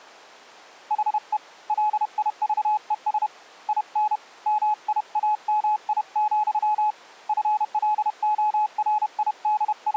Morse code, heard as a keyed tone, hand-sent with a paddle, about 31 wpm, 850 Hz. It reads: HE LIVES IN MIAMI, …